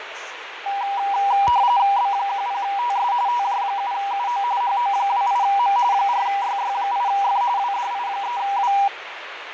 RTTY (45.45 baud, 170 Hz shift), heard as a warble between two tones, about 880 Hz centre, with radio static, fading and the noise of a crowd indoors. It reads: B10TS TJ7UO HO28M 4YY8F WDI3W